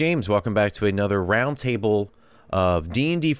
Speech in English. There is no code.